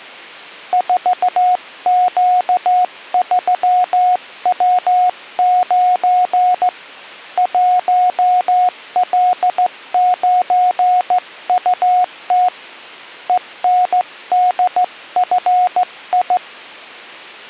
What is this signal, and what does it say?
Morse code, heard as a keyed tone, hand-sent with a straight key, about 15 wpm, 730 Hz. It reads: 4Q3W9 1L9UT ENDFI